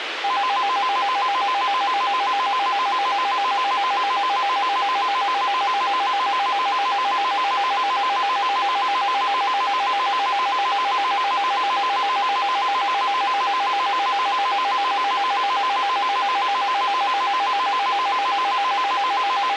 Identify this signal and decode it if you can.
A tone that alternates evenly between two pitches, with radio hiss. There is no code.